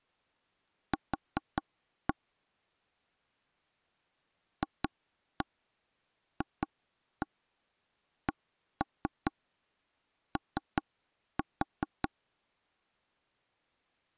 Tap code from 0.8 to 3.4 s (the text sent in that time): Q